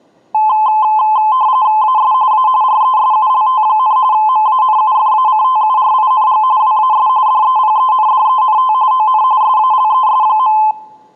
RTTY (45.45 baud, 170 Hz shift), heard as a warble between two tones, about 950 Hz centre. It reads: AS A RESULT, MANUFACTURING WAS DEPENDENT ON SALES.